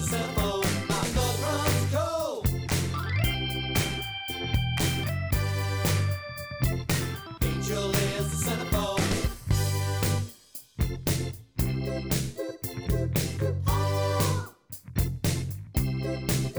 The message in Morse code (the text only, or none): none